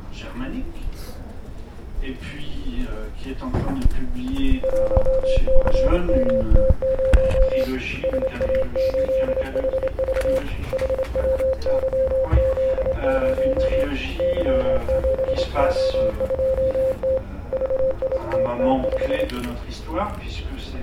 Morse code, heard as a keyed tone, hand-sent with a straight key, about 27 wpm, 530 Hz. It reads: 1CMT0 SA8HV HWYZ0 Y7O2T VITT5